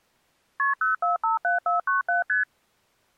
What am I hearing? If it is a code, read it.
Multi-frequency trunk signalling (R1, as on North American trunks), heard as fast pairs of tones, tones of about 140 ms. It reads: KP 0457497 ST